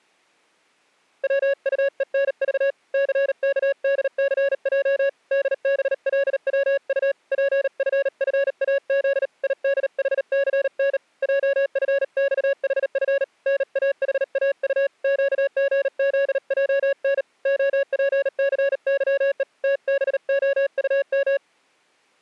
Morse code, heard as a keyed tone, hand-sent with a bug key, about 38 wpm, 560 Hz. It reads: WUENV CKDCJ DBLWU PFFAZ IDHCN JFXHF NAHAU QGZJN OPCYE TBOUM